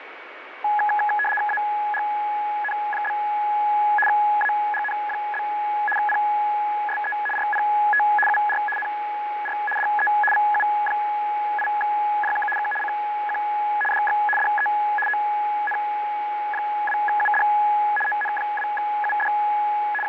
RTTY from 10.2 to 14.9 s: VU8JK K CQ DX DE

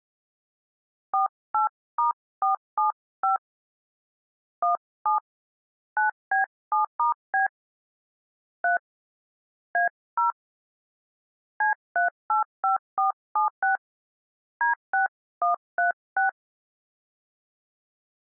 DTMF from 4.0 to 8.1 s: 17 9B7*B

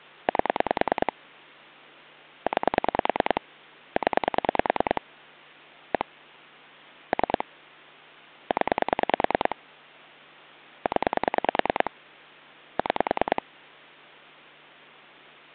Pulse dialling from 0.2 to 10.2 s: 8 9 0 1 3 0

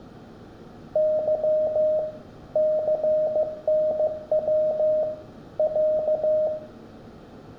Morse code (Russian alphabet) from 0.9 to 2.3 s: Ы

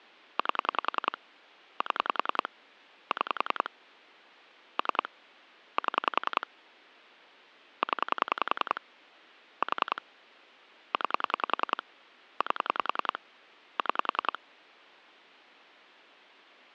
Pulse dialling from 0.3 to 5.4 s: 8 7 6 3

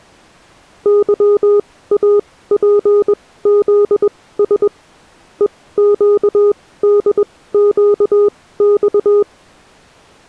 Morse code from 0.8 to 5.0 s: YAPZS

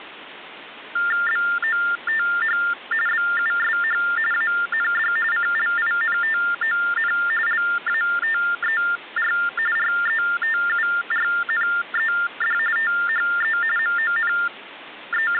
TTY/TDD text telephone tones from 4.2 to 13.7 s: AND CLINTON LATER RETURNED THE

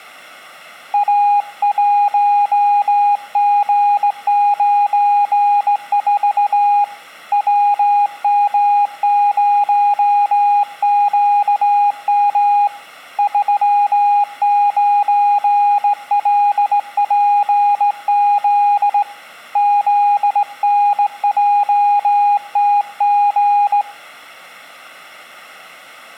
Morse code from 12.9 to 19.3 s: 39LPZ

